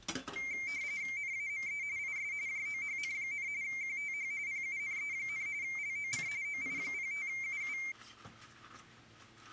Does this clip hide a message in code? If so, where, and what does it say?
Yes: RTTY (45.45 baud, 170 Hz shift) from 0.4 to 7.9 s, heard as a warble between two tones, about 2200 Hz centre, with kitchen noise. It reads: NAME IS JOHN, QTH PUNE, LOC OI05UU